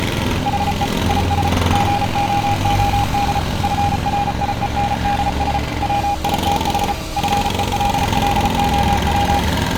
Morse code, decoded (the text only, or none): HE IS GOOD FRIENDS WITH FELLOW